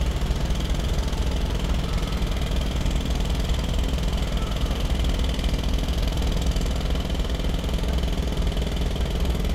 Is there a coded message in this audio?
No, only street noise.